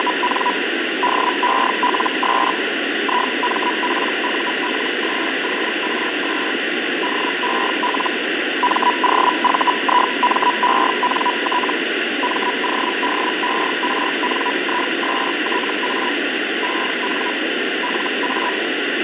Hellschreiber (Feld-Hell, 122.5 baud), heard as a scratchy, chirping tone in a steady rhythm, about 980 Hz, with radio static and fading. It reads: … DELS IMPULSORS DEL MOVIMENT MODERNISTA EN LA